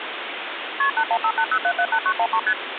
Multi-frequency trunk signalling (R1, as on North American trunks), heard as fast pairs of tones, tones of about 70 ms, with phone line noise. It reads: KP 81580778913 ST